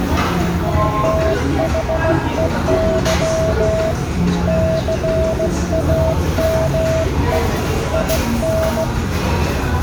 Morse code, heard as a keyed tone, hand-sent with a straight key, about 16 wpm, 650 Hz, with the noise of a restaurant. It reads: THEY CAME IN